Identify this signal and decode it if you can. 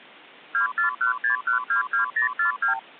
Multi-frequency trunk signalling (R2, with the far end's replies), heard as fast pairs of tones, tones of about 120 ms. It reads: 2416122042